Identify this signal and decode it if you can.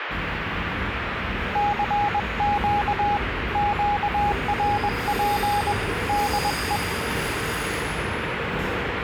Morse code, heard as a keyed tone, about 21 wpm, 820 Hz, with radio static and the noise of a subway station. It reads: CQ QRP DE